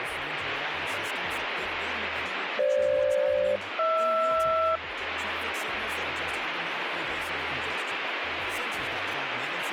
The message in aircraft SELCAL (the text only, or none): FG-HR